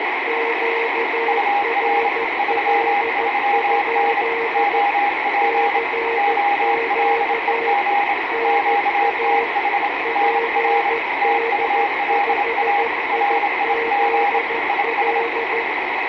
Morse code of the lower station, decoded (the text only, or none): QRL? CQ NA PD5IZL